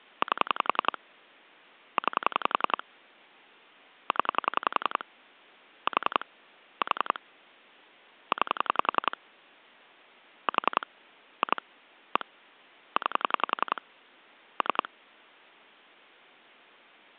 Pulse dialling, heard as clicks on a phone line, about 11 pulses a second. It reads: 8 9 0 4 4 9 4 2 1 9 3